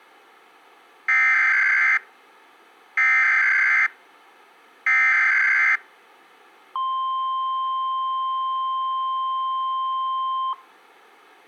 Emergency Alert System (SAME) tones (header bursts, then the 1050 Hz attention tone), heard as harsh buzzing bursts, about 520.83 baud.